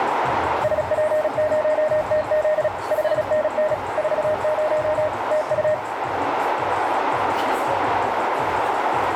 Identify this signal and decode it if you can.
Morse code, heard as a keyed tone, machine-sent, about 36 wpm, 620 Hz, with radio static, a narrow filter and the noise of a cafe. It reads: SP0TZ 5NN 40 TU